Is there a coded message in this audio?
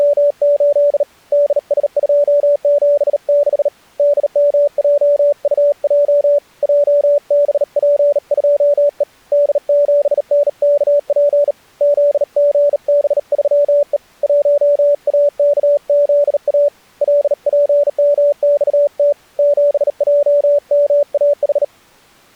Yes: Morse code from 0.0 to 21.7 s, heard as a keyed tone, hand-sent with a bug key, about 38 wpm, 580 Hz. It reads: … DS276 DMJUJ JBP2E D7NKP ZGB3E 1AKZA LPMXT 7JMAH